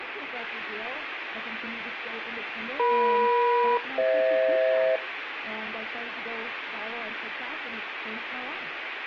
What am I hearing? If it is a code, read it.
Aircraft SELCAL, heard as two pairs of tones, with radio static. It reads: EM-FH